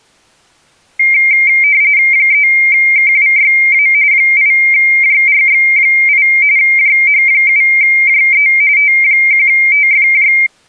RTTY (45.45 baud, 170 Hz shift), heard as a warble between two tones, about 2200 Hz centre. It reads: 3KWYA 8JRX8 JH7JE T1TFJ